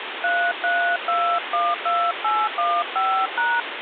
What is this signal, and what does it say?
DTMF, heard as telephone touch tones, dialled by hand, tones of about 260 ms, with phone line noise. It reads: 33212815#